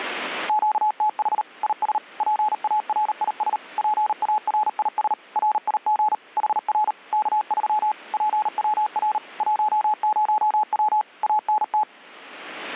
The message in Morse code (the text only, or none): QTH IS PARIS PARIS RIG HR K3 PWR 10W ANT